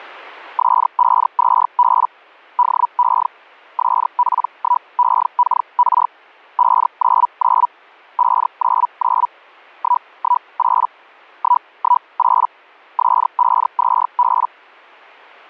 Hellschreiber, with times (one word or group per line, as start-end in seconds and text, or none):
0.6-2.1 S52B
2.6-3.3 DE
3.8-6.1 SP1EKR
6.6-7.7 599
8.2-9.3 599
9.8-10.9 118
11.4-12.5 118
13.0-14.5 S52B